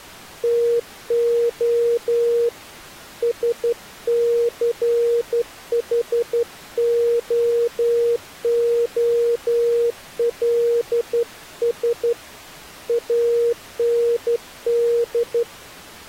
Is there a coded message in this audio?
Yes: Morse code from 0.4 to 15.5 s, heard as a keyed tone, hand-sent with a straight key, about 12 wpm, 470 Hz. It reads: TO SCHOOLS AND